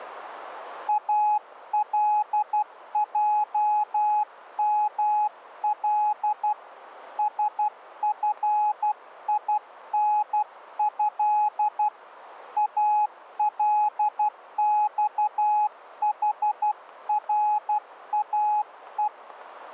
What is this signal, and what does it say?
Morse code (Arabic alphabet), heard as a keyed tone, hand-sent with a paddle, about 12 wpm, 840 Hz, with radio static. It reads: الجمل سفينه الصحراء